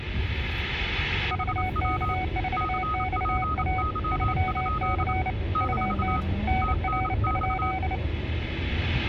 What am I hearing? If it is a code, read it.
Morse code, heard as two keyed tones, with radio static and the noise inside a car. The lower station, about 29 wpm, 750 Hz: VK4XA 3C UT NR?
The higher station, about 27 wpm, 1260 Hz: HW CPY? - TNX